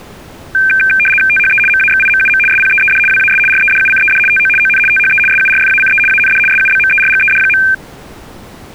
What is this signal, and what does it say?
RTTY (75 baud, 850 Hz shift), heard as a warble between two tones, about 1950 Hz centre. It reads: THE MAXIMUM SPEED WAS REDUCED TO ON THE SURFACE AND SUBMERGED.